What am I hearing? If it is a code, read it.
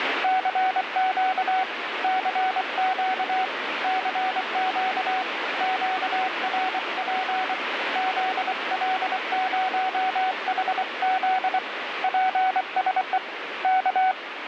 Morse code, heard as a keyed tone, hand-sent with a paddle, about 24 wpm, 750 Hz, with radio static. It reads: CQ CQ CQ QRP ZL0HZ PSE K